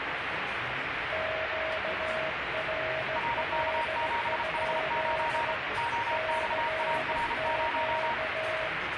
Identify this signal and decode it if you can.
Morse code, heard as two keyed tones, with heavy radio static and the noise of a restaurant. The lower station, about 16 wpm, 640 Hz: QRL? CQ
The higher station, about 33 wpm, 940 Hz: RK7H9 OXAR0